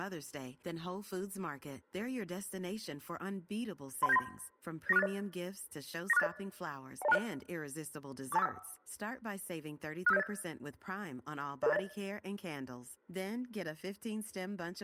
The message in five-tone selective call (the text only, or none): 31793 94680 94680 10260 42451 65708 00080